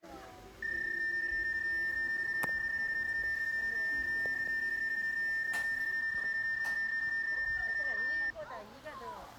PSK31 (31.25 baud), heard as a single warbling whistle, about 1800 Hz, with the noise of a park.